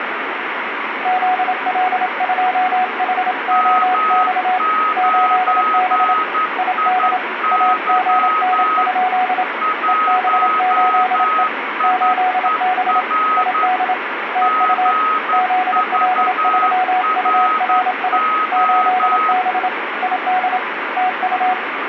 Morse code, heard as two keyed tones, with radio static. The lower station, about 27 wpm, 740 Hz: ZL2HOX 8B ID AGN? EB8E 8B ID TU ZL3URI 8B ID TU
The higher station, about 11 wpm, 1270 Hz: M9IY 1IER GVRO